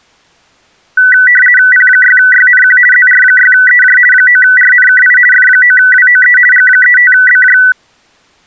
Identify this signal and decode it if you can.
RTTY (50 baud, 450 Hz shift), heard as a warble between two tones, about 1750 Hz centre. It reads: P6YNQ ZR6EJ 9RNKI F9WOE G35BJ